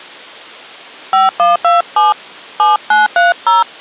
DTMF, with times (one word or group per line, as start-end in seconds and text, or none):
1.1-2.1 5127
2.6-3.6 7930